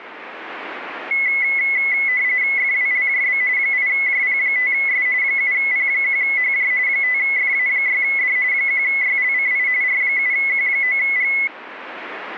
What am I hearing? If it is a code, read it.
RTTY (45.45 baud, 170 Hz shift), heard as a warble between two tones, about 2100 Hz centre. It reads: FWLJB 8JP5S 7P1HJ 5FA6D 1YLCI R7Q9G